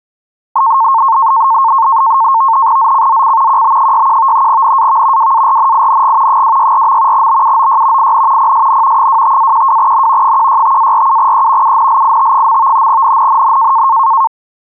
NAVTEX (SITOR-B), 100 baud, 170 Hz shift, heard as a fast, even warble, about 990 Hz centre. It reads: ZCZC QB61 NAV WARNING 264. BUOY IN PSN 25-12N 165-47E UNLIT. NNNN